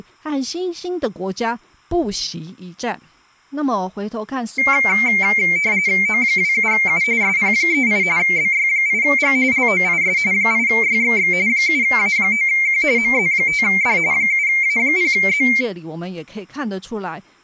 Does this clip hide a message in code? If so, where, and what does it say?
Yes: RTTY (45.45 baud, 170 Hz shift) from 4.6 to 15.6 s, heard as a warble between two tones, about 2200 Hz centre, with speech in Chinese. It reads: O27U SP38 BY8G LOIS 8YXX 7A9Q MZ5D 7A0Z